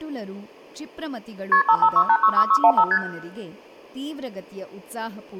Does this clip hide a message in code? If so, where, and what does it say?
Yes: multi-frequency trunk signalling (R1, as on North American trunks) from 1.5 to 3.0 s, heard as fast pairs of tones, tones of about 70 ms, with room echo and speech in Kannada. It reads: KP 556866615 ST